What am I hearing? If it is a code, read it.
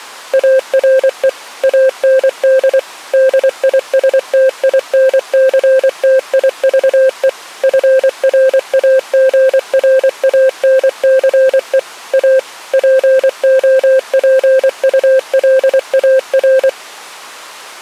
Morse code, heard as a keyed tone, machine-sent, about 24 wpm, 530 Hz. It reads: ARE AND DISTINCTIVE FRAGRANCE A POPULAR